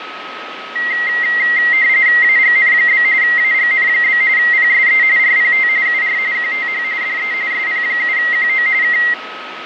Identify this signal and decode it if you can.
RTTY (45.45 baud, 170 Hz shift), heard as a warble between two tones, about 2000 Hz centre, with radio static, fading and a steady whistle near 1280 Hz. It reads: AGN? AGN? PSE RPT UR QTH DE SP7QO K